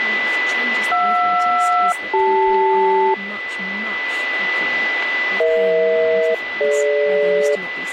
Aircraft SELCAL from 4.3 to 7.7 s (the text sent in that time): EH-DG